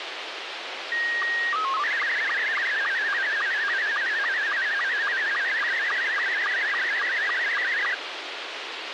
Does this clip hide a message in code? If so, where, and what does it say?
Yes: SSTV (slow-scan television), Scottie S2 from 0.9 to 7.9 s, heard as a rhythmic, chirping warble, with radio hiss and a squelch burst at the end.